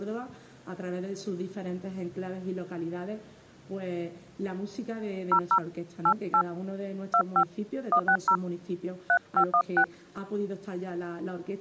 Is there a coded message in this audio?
Yes: DTMF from 5.3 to 9.8 s, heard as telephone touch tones, dialled by hand, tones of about 80 ms. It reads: 00 88 25 160 3516